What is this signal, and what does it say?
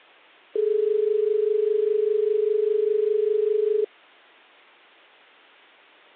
Telephone call progress tone (as in Australia), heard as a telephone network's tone, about 430 Hz. Dial tone.